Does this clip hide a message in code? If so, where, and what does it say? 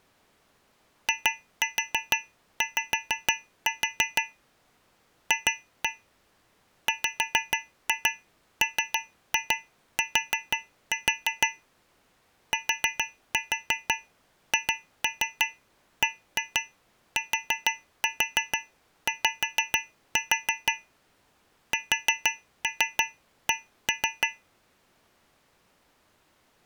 Yes: tap code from 1.1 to 24.5 s, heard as taps on a metal pipe, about 6 knocks a second. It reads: IY F WMT THBTY SC